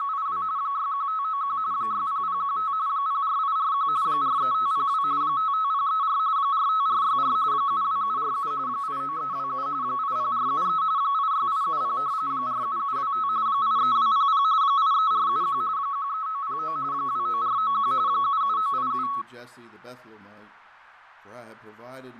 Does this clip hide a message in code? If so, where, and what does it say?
Yes: RTTY (45.45 baud, 170 Hz shift) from 0.0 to 19.2 s, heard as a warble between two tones, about 1200 Hz centre, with fading. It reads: … 61591 60015 04841 43502 55034 45464 72747 89327 80473 86870 47725 83200 83471 13909 29491 77987